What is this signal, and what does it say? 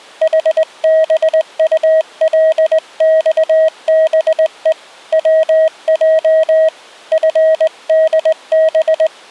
Morse code, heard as a keyed tone, hand-sent with a straight key, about 19 wpm, 640 Hz. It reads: HBULXBE WJ FDB